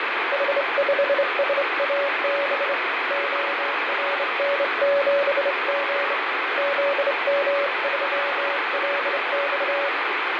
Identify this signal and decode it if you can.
Morse code, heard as a keyed tone, hand-sent with a straight key, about 26 wpm, 560 Hz, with heavy radio static and fading. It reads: H5SAB ORN7G ZM3LX